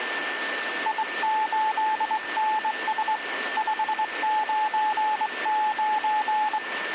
Morse code, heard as a keyed tone, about 22 wpm, 860 Hz, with radio static and a steady whistle near 1780 Hz. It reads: I8NS 599